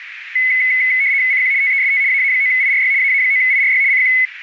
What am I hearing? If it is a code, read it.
RTTY (75 baud, 170 Hz shift), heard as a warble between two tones, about 2100 Hz centre, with radio static and a narrow filter. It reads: CQ TEST AA9IRY AA9IRY CQ